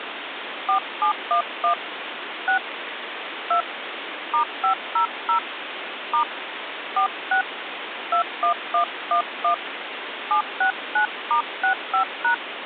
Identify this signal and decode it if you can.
DTMF, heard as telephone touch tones, dialled by hand, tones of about 100 ms, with phone line noise. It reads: 4711 6 2 *500 * 46 21111 769*65#